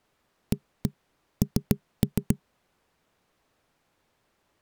Tap code, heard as knocks on wood, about 7 knocks a second. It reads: AN